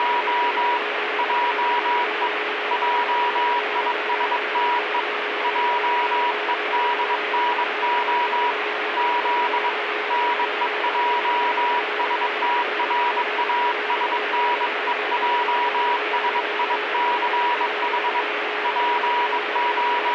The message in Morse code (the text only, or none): … JE JISTE JEDNO Z NEJSTRASNEJSICH …